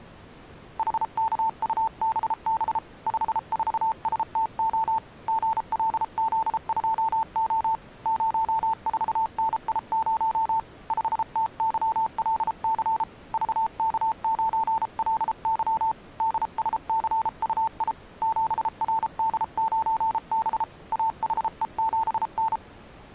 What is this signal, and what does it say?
Morse code, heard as a keyed tone, hand-sent with a paddle, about 33 wpm, 890 Hz. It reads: HKUBB 54STO GLZ2O 04NI0 5TYLC VK9LY DSCUI 7RD9B AHE7N